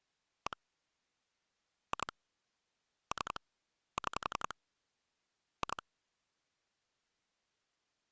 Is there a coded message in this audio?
Yes: pulse dialling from 0.5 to 5.8 s, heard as clicks on a phone line, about 11 pulses a second. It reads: 1 2 3 6 2